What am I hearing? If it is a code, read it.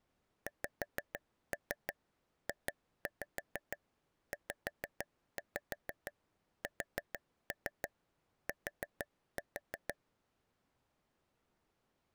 Tap code, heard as taps on a table, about 6 knocks a second. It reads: XJZST